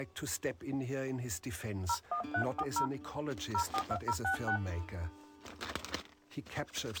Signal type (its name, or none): DTMF